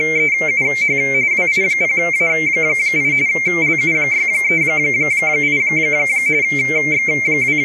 RTTY (45.45 baud, 170 Hz shift), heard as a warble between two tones, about 2200 Hz centre, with room echo. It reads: … WI0A8 LU638 …